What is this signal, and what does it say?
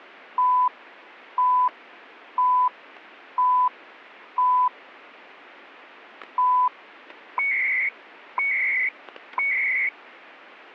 Radio time signal (CHU, Canada), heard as beeps and data bursts, one a second.